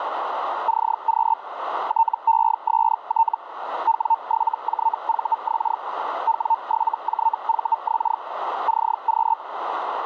Hellschreiber (Feld-Hell, 122.5 baud), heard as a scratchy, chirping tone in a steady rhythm, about 900 Hz, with radio static and a narrow filter. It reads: CQ TEST W7JVX W7JVX CQ